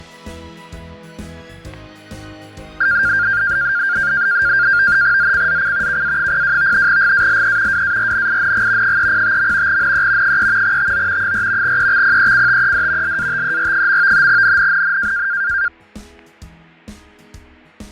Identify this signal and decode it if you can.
NAVTEX (SITOR-B), 100 baud, 170 Hz shift, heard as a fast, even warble, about 1500 Hz centre, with fading and static crashes. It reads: ZCZC KA02 GALE WARNING 305. NE 3 TO 4 EXPECTED LATER. NNNN